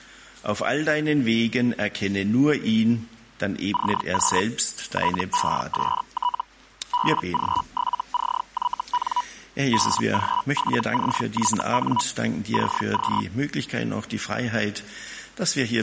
Hellschreiber (Feld-Hell, 122.5 baud), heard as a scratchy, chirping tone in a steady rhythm, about 980 Hz. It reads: CQ TEST BG7CYN BG7CYN CQ